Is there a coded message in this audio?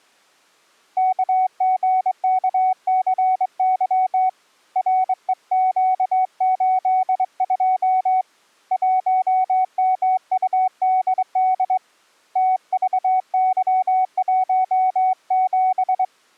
Yes: Morse code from 0.9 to 16.1 s, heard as a keyed tone, hand-sent with a straight key, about 22 wpm, 750 Hz. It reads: KGKCY REQ82 1MUDD TVY17